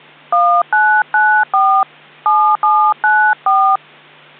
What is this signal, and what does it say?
DTMF, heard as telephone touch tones, dialled by hand, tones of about 290 ms. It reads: 1994 7794